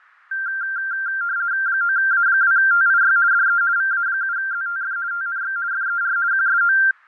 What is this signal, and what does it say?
RTTY (50 baud, 170 Hz shift), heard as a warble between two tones, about 1480 Hz centre, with fading. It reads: 9A2TIY DE VA7ZTF TNX FER QSO